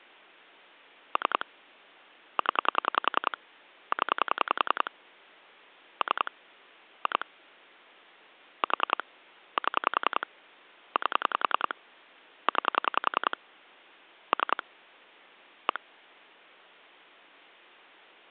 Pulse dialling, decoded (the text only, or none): 3 0 0 3 2 4 7 8 9 3 1